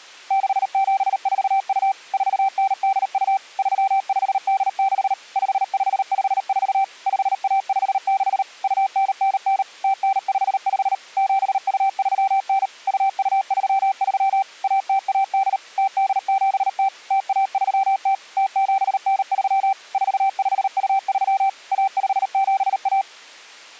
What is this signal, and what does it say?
Morse code (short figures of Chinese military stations), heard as a keyed tone, machine-sent, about 38 wpm, 780 Hz. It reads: 6742 4982 3586 5554 5156 2999 0955 7239 2233 1018 0870 0130 0793 4523 1571